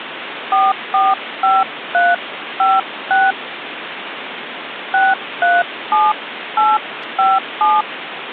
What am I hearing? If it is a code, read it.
DTMF, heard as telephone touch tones, dialled by hand, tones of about 200 ms, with phone line noise. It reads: 445356 637857